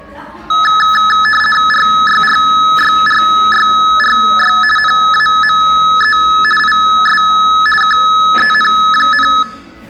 RTTY (50 baud, 450 Hz shift), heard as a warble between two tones, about 1500 Hz centre, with the noise of a crowd indoors. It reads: RYRYRYRY NAME IS KEN,